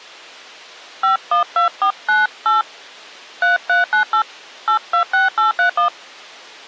DTMF, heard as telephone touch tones, dialled by hand, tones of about 120 ms. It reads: 512498 3398 826831